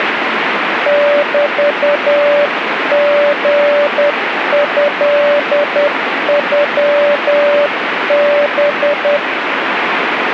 Morse code (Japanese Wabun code), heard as a keyed tone, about 10 wpm, 580 Hz, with radio static. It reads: メリトノハ